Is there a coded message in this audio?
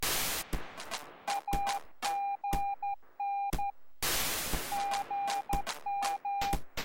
Yes: Morse code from 1.2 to 6.6 s, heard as a keyed tone, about 12 wpm, 800 Hz. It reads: AGN GM